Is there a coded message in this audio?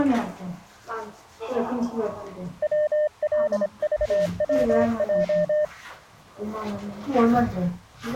Yes: Morse code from 2.6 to 5.7 s, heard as a keyed tone, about 26 wpm, 600 Hz, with the noise inside a lift. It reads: WLVWJ